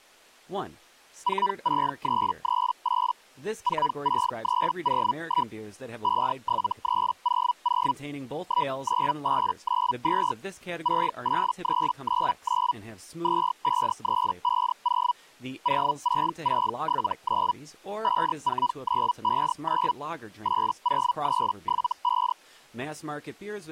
Hellschreiber (Feld-Hell, 122.5 baud), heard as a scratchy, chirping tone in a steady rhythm, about 980 Hz, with speech in English. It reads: 46338 46301 57300 19892 68399 25350 06679 54959 80375